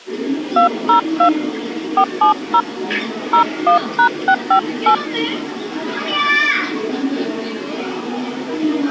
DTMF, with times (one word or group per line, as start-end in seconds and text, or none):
0.6-1.3 202
2.0-2.6 470
3.3-4.9 01#658